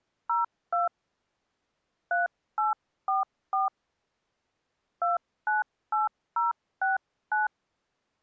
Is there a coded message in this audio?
Yes: DTMF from 0.3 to 7.5 s, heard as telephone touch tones, dialled by hand, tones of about 150 ms. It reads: 02 3844 298069